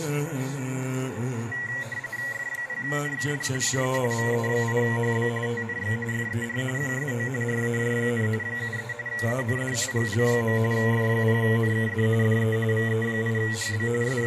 RTTY (45.45 baud, 170 Hz shift), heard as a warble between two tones, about 2000 Hz centre, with radio static. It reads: F0NKD DE VE8HB TNX FER QSO RAJ, 73 AND GL. F0NKD DE VE8HB …